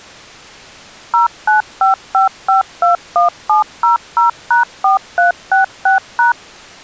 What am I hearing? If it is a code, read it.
DTMF, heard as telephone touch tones, dialled by machine, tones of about 130 ms. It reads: 0955521700#4366#